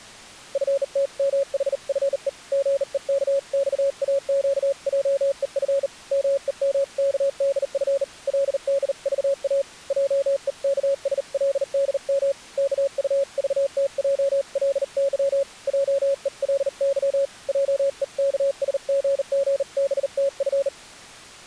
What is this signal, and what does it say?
Morse code (Korean alphabet), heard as a keyed tone, hand-sent with a bug key, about 39 wpm, 550 Hz. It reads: 너무나 상쾌한 맘은 그로 하여금 이렇게 하게 하였던